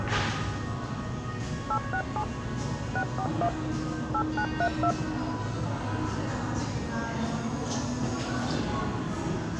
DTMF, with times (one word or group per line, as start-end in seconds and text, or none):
1.7-2.2 867
3.0-3.5 641
4.1-4.9 8932